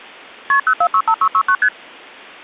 Multi-frequency trunk signalling (R1, as on North American trunks), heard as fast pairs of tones, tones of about 70 ms. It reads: KP 0465669 ST